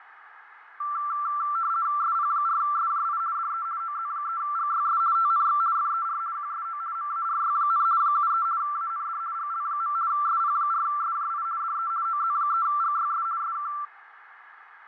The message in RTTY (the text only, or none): SP4SJI DE OZ3GYS TNX FER QSO MARY, 73 AND GL. SP4SJI DE OZ3GYS SK